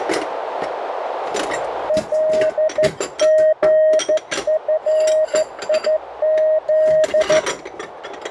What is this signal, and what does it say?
Morse code, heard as a keyed tone, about 13 wpm, 620 Hz, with radio static, a narrow filter and kitchen noise. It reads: LGFIZ